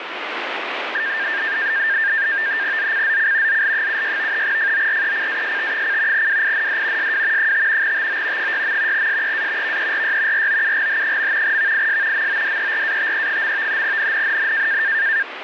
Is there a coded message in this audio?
Yes: NAVTEX (SITOR-B), 100 baud, 170 Hz shift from 0.9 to 15.2 s, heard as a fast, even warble, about 1700 Hz centre, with radio static. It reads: ZCZC ZL76 FORECAST: WIND SW 5 TO 6. SEA VERY ROUGH. VIS MODERATE. NNNN